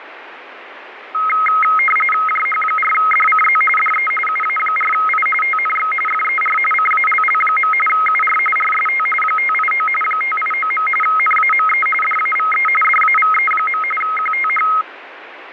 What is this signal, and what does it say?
RTTY (45.45 baud, 850 Hz shift), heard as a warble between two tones, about 1700 Hz centre, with radio static. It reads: JH4DCZ DE UA4I TNX FER CALL. UR RST 589 589. NAME DAVE DAVE. QTH